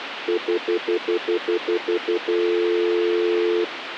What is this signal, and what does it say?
Telephone call progress tone (North American plan), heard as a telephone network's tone, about 350, 440 Hz, 0.1 s on and 0.1 s off, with phone line noise. Stutter dial tone.